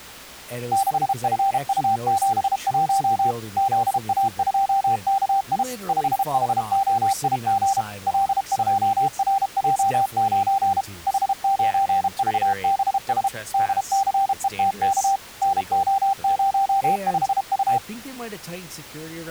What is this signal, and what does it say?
Morse code, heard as a keyed tone, machine-sent, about 32 wpm, 780 Hz, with speech in English. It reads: 6FU71 ZA2KI 5HOIG L2RJ9 H9VBS DCETK NO05U